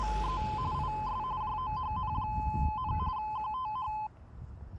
RTTY (45.45 baud, 170 Hz shift), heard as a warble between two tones, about 940 Hz centre, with street noise. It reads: … IS JOHN, QTH